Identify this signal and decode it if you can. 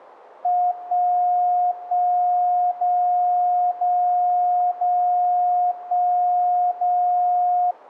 Radio time signal (DCF77), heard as a tone whose level steps once a second, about 720 Hz. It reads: 1 1 0 0 0 1 0